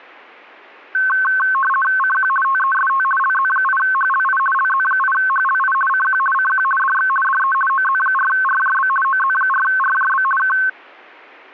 RTTY (50 baud, 450 Hz shift), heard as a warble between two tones, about 1300 Hz centre. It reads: CQ TEST LZ8HLI LZ8HLI CQ CQ DX DE OZ4RJB OZ4RJB K